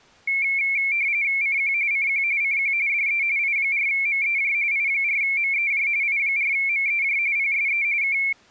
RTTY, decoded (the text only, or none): CQ CQ CQ DE I4MEJ I4MEJ I4MEJ PSE K